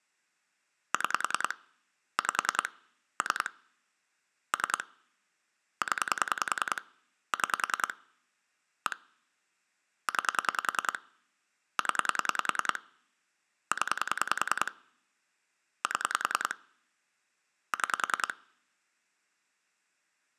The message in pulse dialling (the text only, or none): 6 5 3 3 0 6 1 9 0 0 7 6